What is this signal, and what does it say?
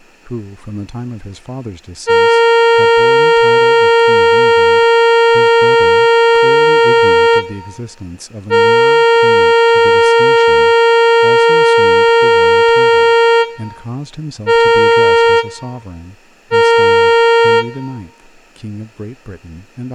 Ship horn signal, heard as a ship's horn, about 460 Hz, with room echo and speech in English. 2 long, 2 short. At sea: I intend to overtake on your port side.